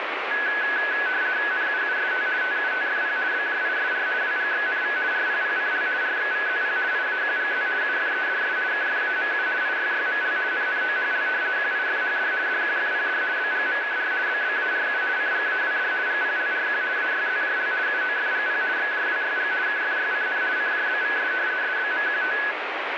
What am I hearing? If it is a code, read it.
RTTY (50 baud, 170 Hz shift), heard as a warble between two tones, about 1600 Hz centre, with radio static. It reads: NUUST TUTFP BJISR WGXNV RPPCL RXVZP IAQGZ UFEDS KFAMU IYYML NNOHL QIFHD DQFPD BGMKR BBARU CGAWD GPLRQ AYZJL UOFGP XJWYG KFYCN CJBVS SBMQT